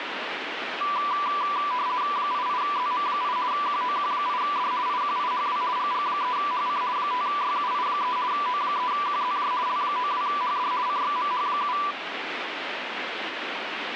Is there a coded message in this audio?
Yes: RTTY (50 baud, 170 Hz shift) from 0.8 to 11.9 s, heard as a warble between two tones, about 1080 Hz centre, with radio static. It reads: 88ZM8 QOQ8D IQIHW GG3HC 5YUI3 O3QZJ L92HD CXMH7